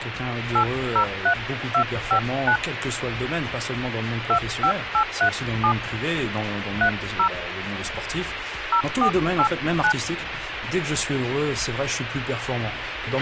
DTMF, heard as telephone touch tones, dialled by hand, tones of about 80 ms, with radio hiss and a squelch burst at the end. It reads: 803259 25837 30 0489